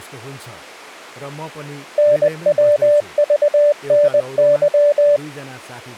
Morse code, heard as a keyed tone, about 20 wpm, 590 Hz, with speech in Nepali. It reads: NWVNY